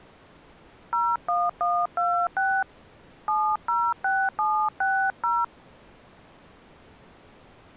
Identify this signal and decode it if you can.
DTMF, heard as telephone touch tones, dialled by hand, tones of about 260 ms. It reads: 01126 706760